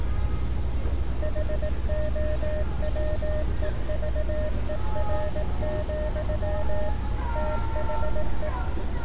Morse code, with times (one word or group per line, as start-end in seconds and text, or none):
1.2-6.9 HOWEVER,
7.4-8.5 THE